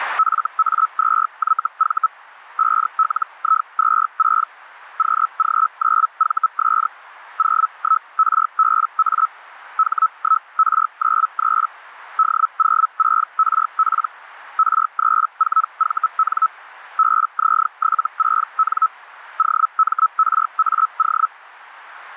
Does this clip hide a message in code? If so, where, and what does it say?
Yes: Hellschreiber (Feld-Hell, 122.5 baud) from 0.2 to 21.3 s, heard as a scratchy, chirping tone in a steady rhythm, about 1300 Hz, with radio static. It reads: FA2YV 5LI26 QG9VS 01RBA H1R93 D06RP R34VN BZ76N OMRAO